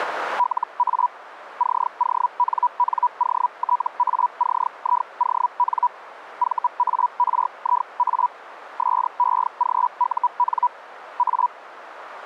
Hellschreiber (Feld-Hell, 122.5 baud), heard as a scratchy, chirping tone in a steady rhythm, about 980 Hz. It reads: LA CONNOTACION VARIA SEGUN A